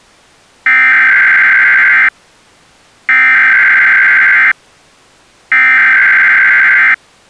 Emergency Alert System (SAME) tones (header bursts), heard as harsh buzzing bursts, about 520.83 baud.